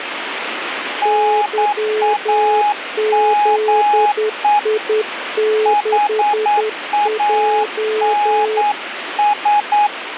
Morse code, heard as two keyed tones, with radio static. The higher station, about 9 wpm, 830 Hz: NAME HANS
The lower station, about 10 wpm, 430 Hz: YZI6J